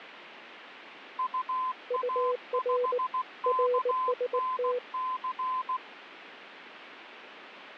Morse code, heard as two keyed tones, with radio static. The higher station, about 16 wpm, 1030 Hz: UA5KNC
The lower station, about 19 wpm, 490 Hz: UR RST